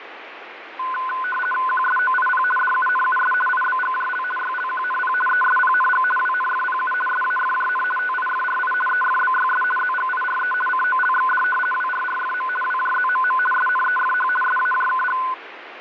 RTTY (50 baud, 450 Hz shift), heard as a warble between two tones, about 1260 Hz centre, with radio static. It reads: QSOIP DUNUS IBGJL YLQNP ESPNG WNFPU SAFJN TIFRI EFBYS ZGIRE COLXD WRRFM WJZMM SNEFH SAJKG